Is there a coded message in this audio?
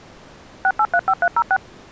Yes: DTMF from 0.6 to 1.6 s, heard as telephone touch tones, dialled by machine, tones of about 60 ms. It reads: 6835306